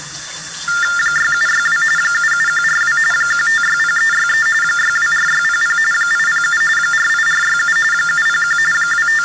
TTY/TDD text telephone tones (45.45 baud Baudot), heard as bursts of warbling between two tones, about 400 Hz shift, 1600 Hz centre, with kitchen noise. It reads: 6762 77142 1560363 624600 807 48467 701 …